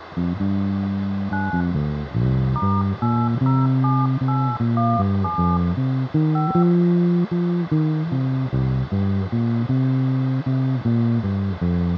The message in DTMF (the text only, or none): 9 *807817 5